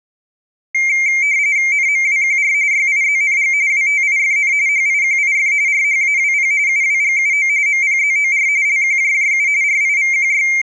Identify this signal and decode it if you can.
RTTY (45.45 baud, 170 Hz shift), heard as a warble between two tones, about 2200 Hz centre. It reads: NMWQR YIZNG WTIFN HIQIF RHAWP UWGUO MPZOR LQJJU RIVQY